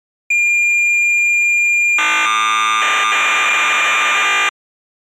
Cassette data (Kansas City type), 1200 baud, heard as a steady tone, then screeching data.